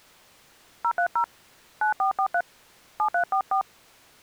DTMF, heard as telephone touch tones, dialled by hand, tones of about 90 ms. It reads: 030 9443 7344